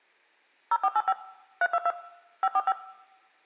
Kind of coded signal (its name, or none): DTMF